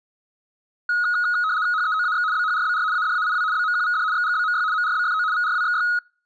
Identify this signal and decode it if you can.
RTTY (75 baud, 170 Hz shift), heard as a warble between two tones, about 1360 Hz centre. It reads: HEOAX BHRBR ADAIW BMQVD XGBMY MRBFO VRWXY